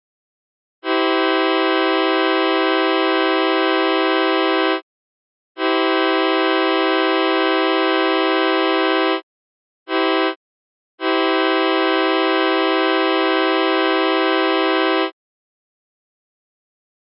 Train horn signal, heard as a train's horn. 2 long, 1 short, 1 long. On North American railways: approaching a public crossing.